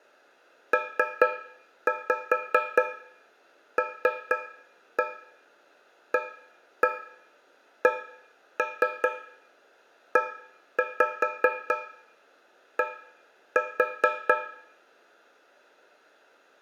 Tap code, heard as taps on a metal pipe, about 4 knocks a second, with room echo. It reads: PLACED